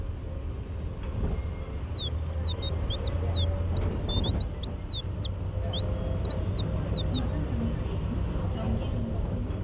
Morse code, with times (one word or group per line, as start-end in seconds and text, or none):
none